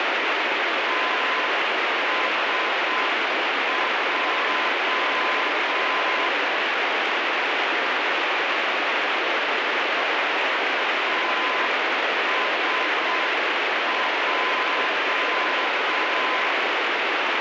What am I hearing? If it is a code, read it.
Morse code, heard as a keyed tone, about 6 wpm, 1020 Hz, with heavy radio static. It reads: TSJ TSJ